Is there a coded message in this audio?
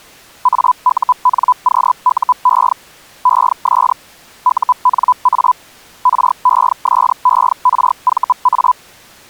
Yes: Hellschreiber (Feld-Hell, 122.5 baud) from 0.4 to 8.7 s, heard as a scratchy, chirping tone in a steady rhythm, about 1000 Hz. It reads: AUNQUE ES UNA RESERVA